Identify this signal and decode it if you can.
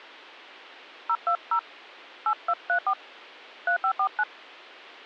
DTMF, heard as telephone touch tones, dialled by hand, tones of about 80 ms. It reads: 020 8234 3549